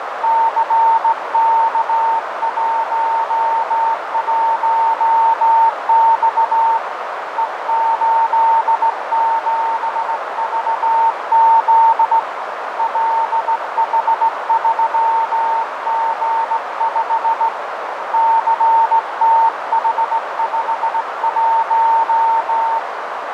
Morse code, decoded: CK11X E87VZ LH3G5 CTH51

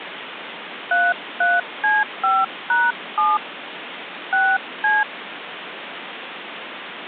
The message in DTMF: 33C5#7 6C

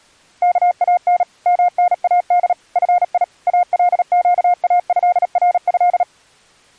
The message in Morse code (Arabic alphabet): كان مناد في القاهره

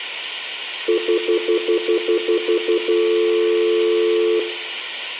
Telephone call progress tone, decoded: stutter dial tone

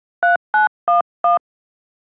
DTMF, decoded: 3911

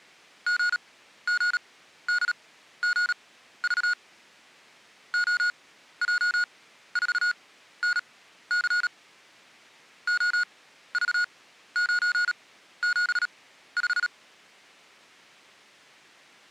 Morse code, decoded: GGDGV OJ4NC OV975

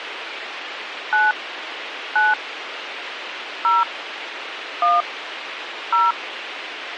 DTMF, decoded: 9 9 0 1 0

